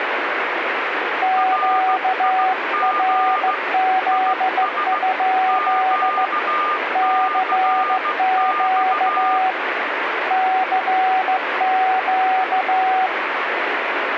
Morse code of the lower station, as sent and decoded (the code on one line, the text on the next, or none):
--.- .-. --.. ..--.. / -.-. --.- / -.-. --.-
QRZ? CQ CQ